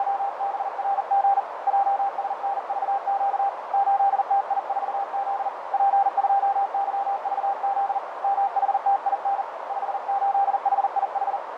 Morse code, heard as a keyed tone, hand-sent with a paddle, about 40 wpm, 790 Hz, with radio static and a narrow filter. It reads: … JSNVQ 8TI4Z P2YVZ MHTIN 58HIH